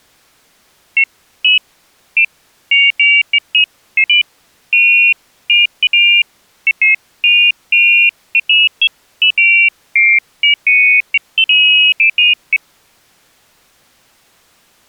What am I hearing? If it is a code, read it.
Pairs of high tones at irregular times. There is no code.